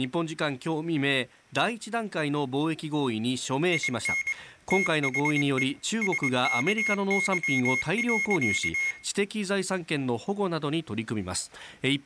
Morse code, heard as a high beeper, machine-sent, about 22 wpm, 2150 Hz, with room echo and speech in Japanese. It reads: IN THE SKY.